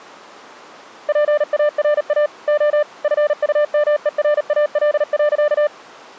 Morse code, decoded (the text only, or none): PARA O FUMERAL.